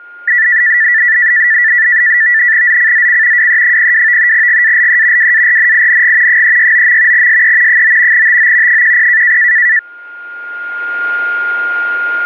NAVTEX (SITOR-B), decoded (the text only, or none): ZCZC WE02 GALE WARNING 369. SE 9 TO 10